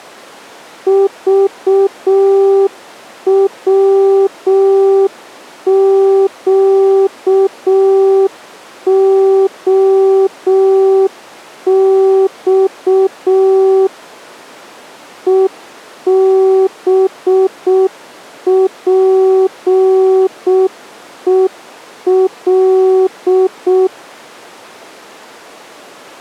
Morse code, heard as a keyed tone, machine-sent, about 6 wpm, 380 Hz. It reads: VWQOX EBPEL